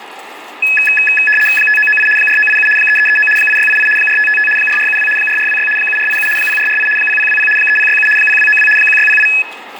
RTTY (75 baud, 850 Hz shift), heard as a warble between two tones, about 2150 Hz centre, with radio static, room echo and kitchen noise. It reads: 5998 4987 3339 8688 4555 4472 4426 7487 0448 0020 3067 0292 1608